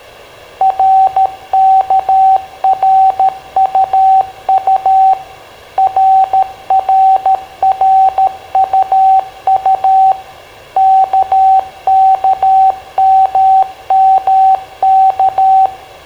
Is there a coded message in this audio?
Yes: Morse code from 0.5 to 15.7 s, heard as a keyed tone, machine-sent, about 13 wpm, 770 Hz, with room echo. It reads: RKRUU RRRUU KKMMK